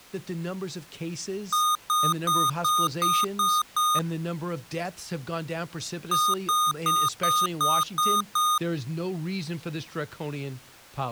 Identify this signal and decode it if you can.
Beep code, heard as beeps from a small speaker, played twice, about 1230 Hz, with speech in English. 7 short. In AMI BIOS tables: virtual mode exception error; in Dell tables: processor failure.